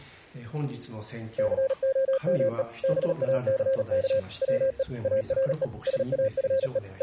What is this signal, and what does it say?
Morse code, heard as a keyed tone, machine-sent, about 38 wpm, 530 Hz. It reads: COME BACK WE ARE SAFE …